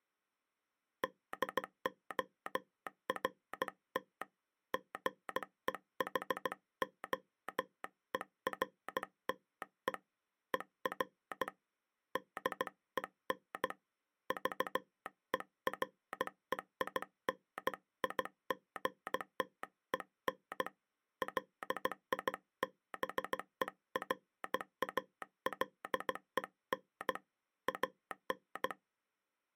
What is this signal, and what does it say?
Morse code, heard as a telegraph sounder, hand-sent with a bug key, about 16 wpm. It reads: DORT GEHOERTE ER DEN VEREINIGTEN LIBERALEN AN